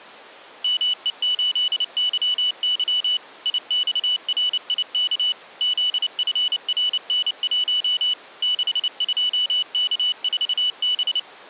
Morse code, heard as a high beeper, machine-sent, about 29 wpm, 2950 Hz. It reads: ME8YY IXRIK ZFRN1 62K4B